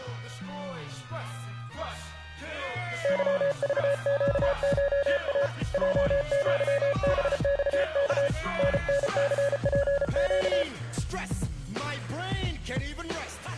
Morse code (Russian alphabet), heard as a keyed tone, hand-sent with a paddle, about 34 wpm, 560 Hz. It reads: ЫЖЩША ЙЪБЬК ННЦПЩ